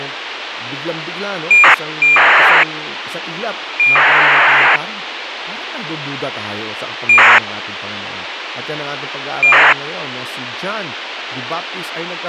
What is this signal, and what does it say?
ACARS aircraft data, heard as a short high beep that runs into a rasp, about 2400 baud, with radio hiss and speech in Filipino.